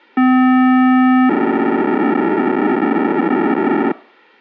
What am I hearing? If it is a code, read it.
POCSAG pager data (512 baud), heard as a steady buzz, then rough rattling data.